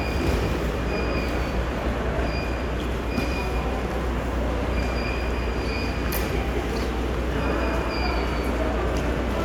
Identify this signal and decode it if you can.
The noise of a subway station. There is no code.